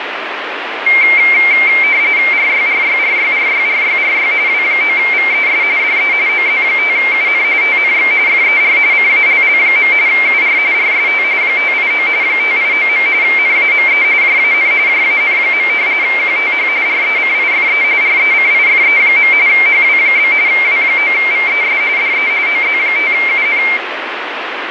RTTY (45.45 baud, 170 Hz shift), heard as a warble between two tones, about 2200 Hz centre, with radio static. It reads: RYRYRYRYRYRY W9VES DE OZ5UN TNX FER CALL. UR RST 589 589. NAME JAN JAN. QTH RECIFE RECIFE. HW? W9VES DE OZ5UN